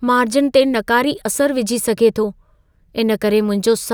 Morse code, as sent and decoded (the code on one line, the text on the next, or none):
none